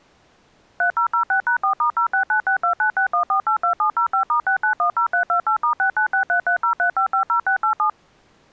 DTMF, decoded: 3006#4*06962961482705*6910328*6963303550687

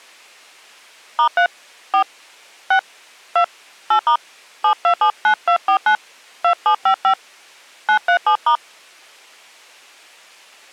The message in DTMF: *3 4 6 2 8* 7279249 2755 937*

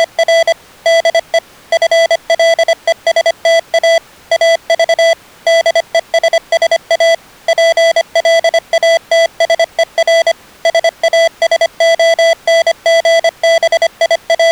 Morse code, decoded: … DE FLESTA AV DESSA PLATSER …

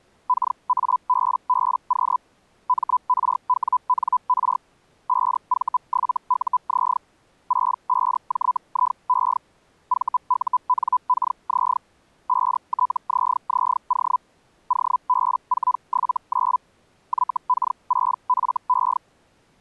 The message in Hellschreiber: KABBQ MRWNR 5V7UZ 65JIE VUNKZ 5TZZO OB479 YK6FE

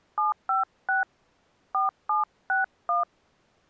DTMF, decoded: 756 4761

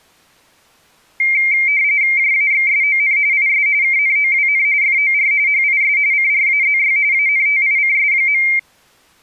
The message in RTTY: JAXSON IS KNOWN FOR HIS CRAZY ANTICS.

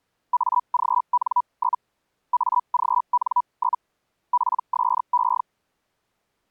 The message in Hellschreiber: AGN? AGN? PSE

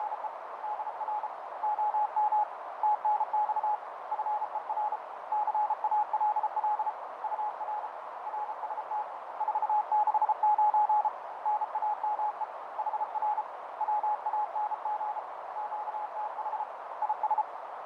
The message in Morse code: … DR OM TNX FER CALL UR RST 469 NAME HR WANG QTH IS

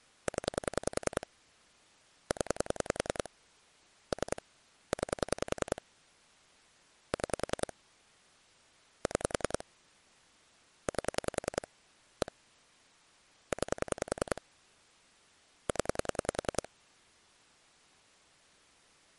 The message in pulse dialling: 0 0 3 9 6 6 8 1 9 0

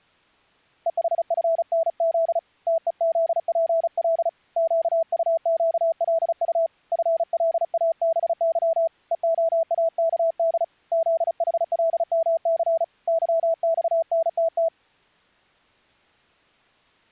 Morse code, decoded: EHFNZ TEZPL QUQLU FLABY EOAKD ZHLMC YXNTT

